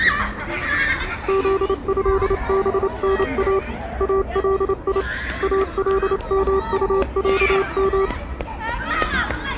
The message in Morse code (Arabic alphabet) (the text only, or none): ذهبنا الي المطعم